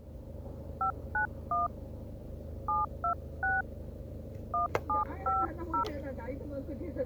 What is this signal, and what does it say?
DTMF, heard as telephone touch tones, dialled by hand, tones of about 140 ms, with the noise inside a car. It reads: 591 726 1750